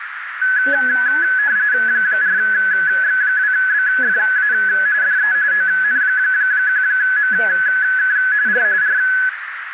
RTTY (45.45 baud, 170 Hz shift), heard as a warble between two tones, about 1600 Hz centre, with radio static, a narrow filter and speech in English. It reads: 4X2BFA DE ON1MK R R